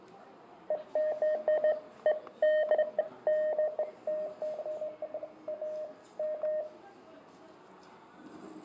Beeps of irregular length, with fading, static crashes, room echo and the noise of a restaurant. There is no code.